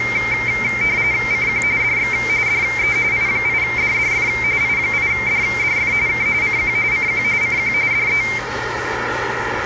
RTTY (45.45 baud, 170 Hz shift), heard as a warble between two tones, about 2200 Hz centre, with radio static, room echo and the noise of a cafe. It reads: CQ DX DE I8DDF I8DDF K CQ CQ CQ DE